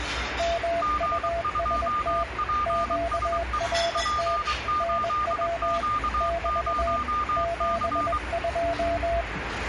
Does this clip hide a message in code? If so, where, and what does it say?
Yes: Morse code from 0.3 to 9.3 s, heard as two keyed tones, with radio static and the noise of a restaurant. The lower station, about 21 wpm, 680 Hz: MUST QRT NW <BT> 72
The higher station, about 23 wpm, 1210 Hz: G2PSE P8Q0C